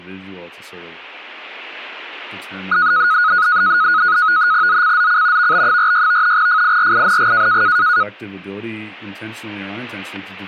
NAVTEX (SITOR-B), 100 baud, 170 Hz shift, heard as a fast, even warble, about 1360 Hz centre, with speech in English. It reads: ZCZC VB46 FIRING